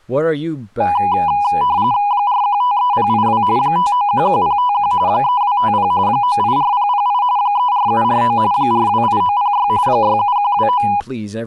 RTTY (45.45 baud, 170 Hz shift), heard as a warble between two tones, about 900 Hz centre, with speech in English. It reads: 4153082 5911051 3250 984008 34749 428906 67129